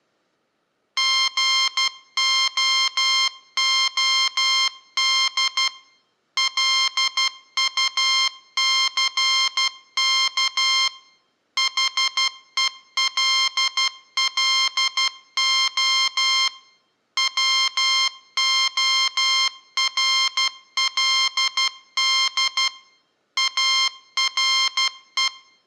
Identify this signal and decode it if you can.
Morse code, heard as electronic beeps, machine-sent, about 12 wpm, 1060 Hz, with room echo. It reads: GOOD LUCK HELLO WORLD ARE